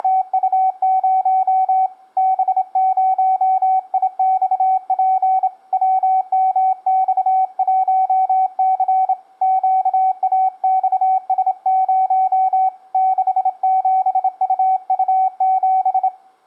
Morse code, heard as a keyed tone, hand-sent with a straight key, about 27 wpm, 760 Hz, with room echo. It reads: … B0IXP WMX1C QAXS0 67UU7